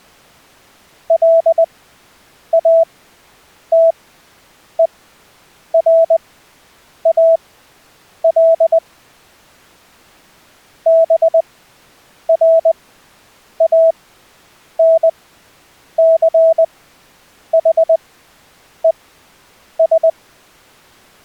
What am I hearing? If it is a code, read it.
Morse code, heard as a keyed tone, machine-sent, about 20 wpm, spaced as for 8 wpm, 660 Hz. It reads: LATERAL BRANCHES